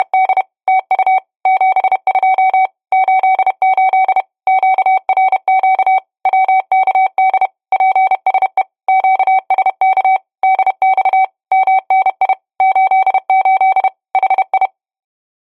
Morse code, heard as a keyed tone, machine-sent, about 31 wpm, 760 Hz. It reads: … TU 72 88 QRQ WKD PSE QSK DX MNI 88 HI